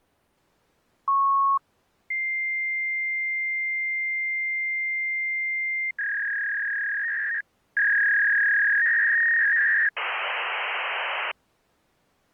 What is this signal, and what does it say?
Fax machine handshake, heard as a beep, a long tone, a warble and hiss.